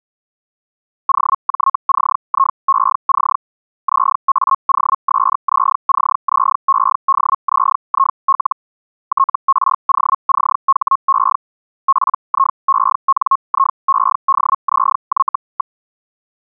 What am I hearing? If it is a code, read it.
Hellschreiber (Feld-Hell, 122.5 baud), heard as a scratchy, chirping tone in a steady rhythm, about 1080 Hz. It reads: OJCIEC ZAOSZCZEDZIL TROCHE PIENIEDZY.